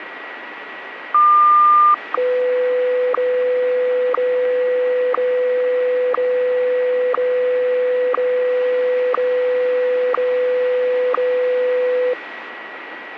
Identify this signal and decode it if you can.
Radio time signal (WWVH, Hawaii), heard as ticks, one a second, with radio static and a steady whistle near 1930 Hz.